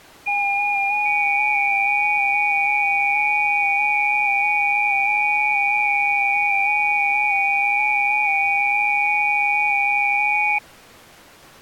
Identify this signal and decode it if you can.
FT8 (several signals at once), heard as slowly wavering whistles, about 6.25 baud.